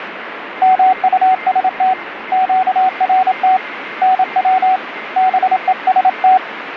Morse code, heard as a keyed tone, hand-sent with a paddle, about 27 wpm, 750 Hz, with radio static and a weaker station near 2100 Hz. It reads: MUST QRT NW BEST